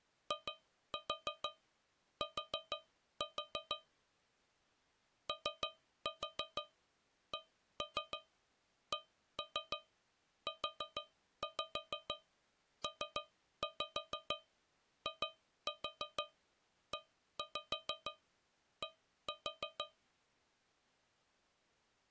Tap code, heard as taps on a metal pipe, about 6 knocks a second. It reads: IT OCCUPIED